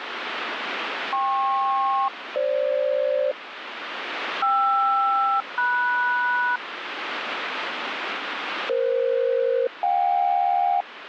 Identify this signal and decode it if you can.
Aircraft SELCAL, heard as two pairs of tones, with radio static. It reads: KP-FG KR-MS EF-JK